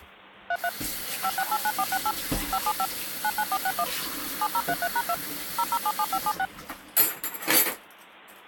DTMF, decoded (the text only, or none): 33 5689468 575 99461 7033#2 0077576